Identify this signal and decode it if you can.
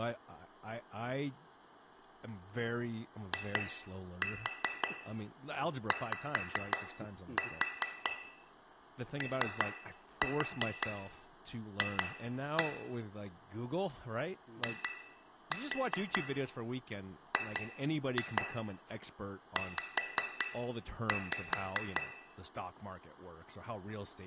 Tap code, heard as taps on glass, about 5 knocks a second, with room echo and speech in English. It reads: IYOF IGZ